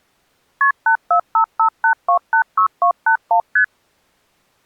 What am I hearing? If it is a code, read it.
Multi-frequency trunk signalling (R1, as on North American trunks), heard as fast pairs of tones, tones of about 90 ms. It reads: KP 84558286281 ST